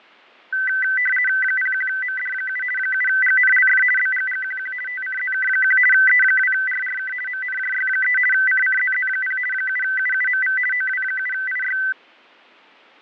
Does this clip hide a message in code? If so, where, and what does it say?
Yes: RTTY (50 baud, 450 Hz shift) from 0.5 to 11.9 s, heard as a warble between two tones, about 1750 Hz centre, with fading. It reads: 01MD7 7GNLF BGGQQ TCZK1 E2RRK MNJY3 CCZZ0 7UUMV OW7IY